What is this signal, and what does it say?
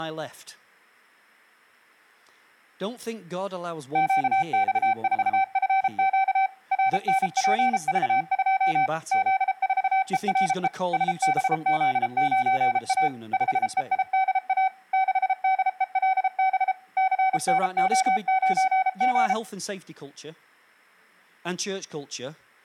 Morse code, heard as a keyed tone, machine-sent, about 33 wpm, 770 Hz, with speech in English. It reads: QX4FQ RNPV2 Z4ERE SBZ9A 5EIDA 6DELB CNO9G